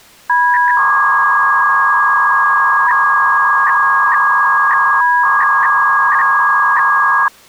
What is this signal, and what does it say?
300-baud modem data (V.21 tones), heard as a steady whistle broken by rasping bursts, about 300 baud, 200 Hz shift.